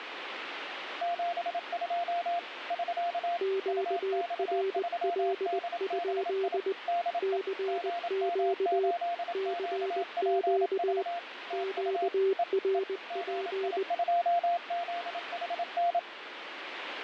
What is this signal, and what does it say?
Morse code, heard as two keyed tones, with radio static. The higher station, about 27 wpm, 690 Hz: 72 <SK> UX3DBI DE GM8QPV TU E E GI2ZHN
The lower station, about 20 wpm, 390 Hz: QRL? CQ CQ QRP